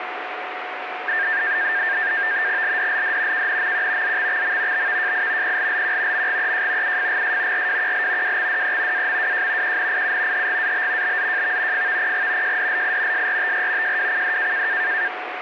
NAVTEX (SITOR-B), 100 baud, 170 Hz shift, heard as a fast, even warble, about 1700 Hz centre, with radio static and a steady whistle near 730 Hz. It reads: LDLD KNMQ ZXXM BVJI PLLQ MGEJ UFGS RWQL WXDE AMWJ QNIU HGAB BZJV FVPG JDLI SRTR JWCD